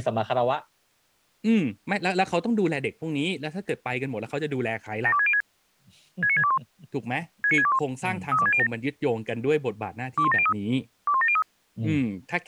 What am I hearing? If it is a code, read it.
Five-tone selective call (ZVEI), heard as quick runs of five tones, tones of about 70 ms, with speech in Thai. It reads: 72606 69621 69621 32607 21703 21703